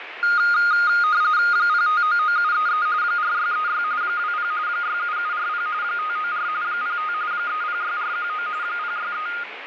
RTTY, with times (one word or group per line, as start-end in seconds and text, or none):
1.5-2.9 0599733
3.0-3.8 4636
4.0-4.5 20
4.7-5.7 67740
5.8-6.5 594
6.6-7.1 05
7.3-8.5 306419
8.6-9.3 063